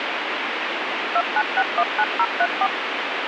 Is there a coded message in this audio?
Yes: DTMF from 1.2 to 2.7 s, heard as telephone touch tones, dialled by machine, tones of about 60 ms, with radio hiss. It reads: 29619034